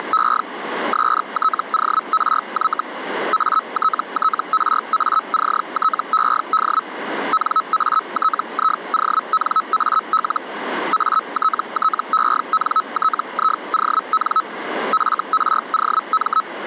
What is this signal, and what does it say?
Hellschreiber (Feld-Hell, 122.5 baud), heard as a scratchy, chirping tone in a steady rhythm, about 1290 Hz. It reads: … STORY ATTRACTED NATIONAL ATTENTION FROM